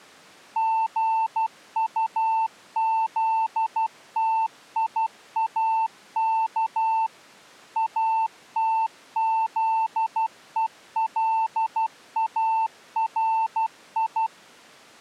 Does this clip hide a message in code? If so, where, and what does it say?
Yes: Morse code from 0.5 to 14.3 s, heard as a keyed tone, machine-sent, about 12 wpm, 890 Hz. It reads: GUZTIAK ATZELARI